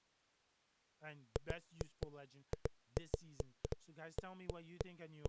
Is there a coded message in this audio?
No, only irregular knocks on a wall, with speech in English.